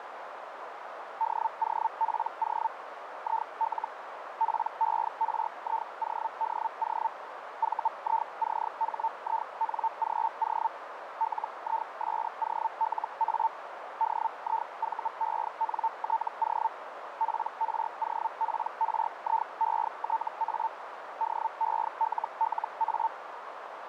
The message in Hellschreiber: DOPO IL PERIODO VICHINGO LISOLA DIVENTO PROPRIETA DELLA

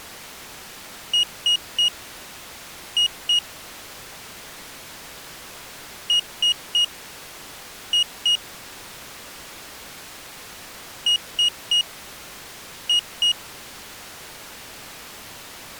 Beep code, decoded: 3-2

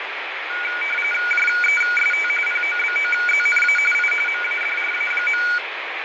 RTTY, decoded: JEST POBOZNA I MADRA.

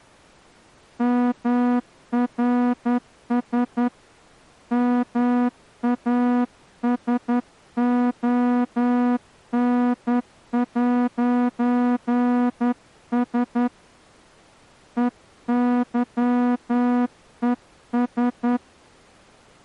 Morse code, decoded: MRS MASON'S EYES

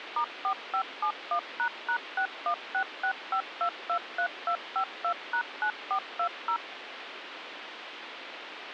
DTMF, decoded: *4571##61665223252#9420

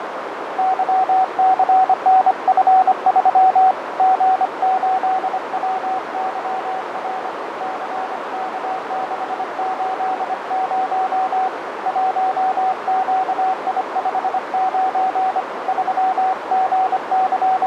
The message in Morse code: YCNF3 G8WYR CK680 1QI59 …

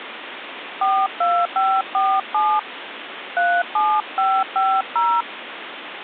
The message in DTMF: 42547 37550

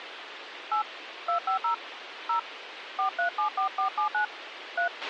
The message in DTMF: 8 250 0 4374479 3

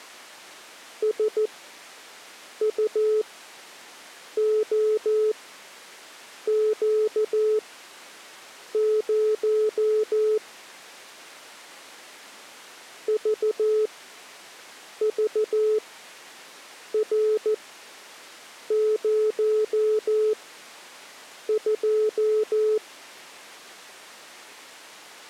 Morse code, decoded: SUOQ0 VVR02

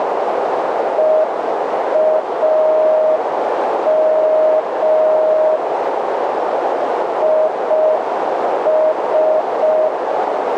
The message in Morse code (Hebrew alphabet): ואם יש

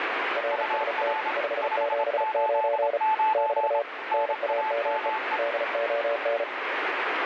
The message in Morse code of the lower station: RST 579 <BT> NAME DON

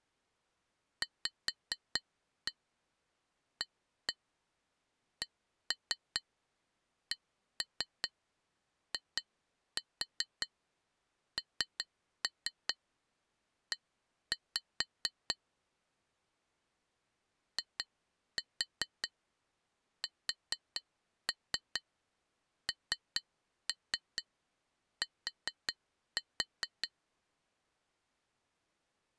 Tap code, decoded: VACCINE ISNT

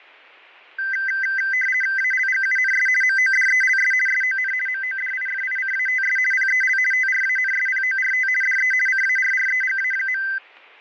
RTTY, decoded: ALGUNS MODELS SON MODIFICATS PEL TRANSPORT DE CARREGA.

